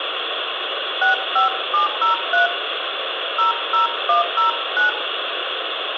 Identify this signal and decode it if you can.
DTMF, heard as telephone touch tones, dialled by hand, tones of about 130 ms, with phone line noise and room echo. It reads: 65703 00109